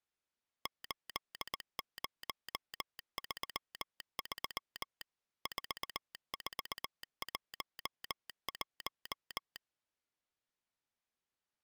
Morse code, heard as a telegraph sounder, machine-sent, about 19 wpm. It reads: 8033 4411